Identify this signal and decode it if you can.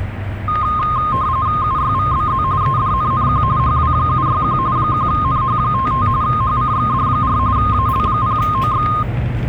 RTTY (45.45 baud, 170 Hz shift), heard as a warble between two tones, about 1150 Hz centre, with static crashes and the noise inside a bus. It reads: UYVBZ EDNNQ HW761 1NH55 HCXD4 AL0OX